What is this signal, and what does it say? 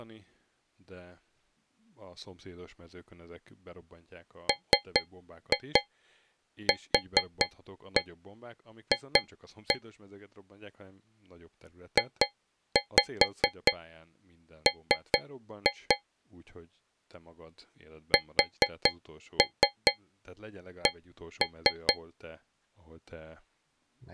Tap code, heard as taps on a metal pipe, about 4 knocks a second, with speech in Hungarian. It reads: MQF JM SC